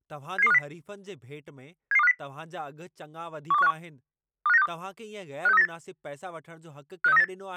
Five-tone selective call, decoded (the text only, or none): 77250 77250 12151 25962 56398 56398